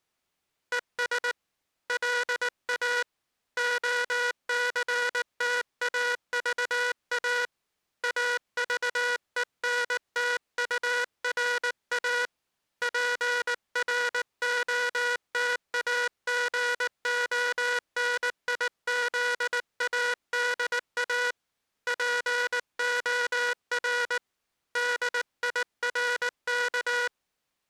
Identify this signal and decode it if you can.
Morse code, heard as a buzzer, hand-sent with a paddle, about 19 wpm. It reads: ES LA OCTAVA AVENTURA PROTAGONIZADA POR DIRK